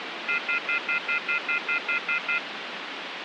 Telephone call progress tone (North American plan), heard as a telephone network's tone, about 1400, 2050, 2450, 2600 Hz, 0.1 s on and 0.1 s off, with phone line noise. Off-hook warning tone.